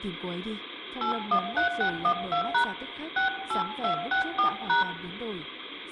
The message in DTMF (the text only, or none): 813612# 68264#